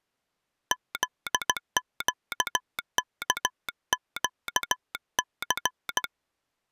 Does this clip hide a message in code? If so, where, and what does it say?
Yes: Morse code (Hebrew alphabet) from 0.7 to 6.1 s, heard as a telegraph sounder, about 16 wpm. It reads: זקכקס